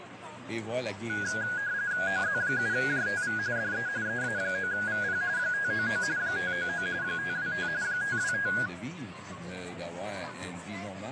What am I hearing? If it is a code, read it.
RTTY (45.45 baud, 170 Hz shift), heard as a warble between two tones, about 1550 Hz centre, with radio static. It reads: OZ7JTV DE EA9VP 599 599 525 525